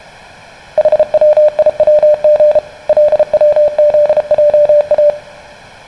Morse code (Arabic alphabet), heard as a keyed tone, hand-sent with a paddle, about 33 wpm, 600 Hz, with room echo. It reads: حويوغ لوذجا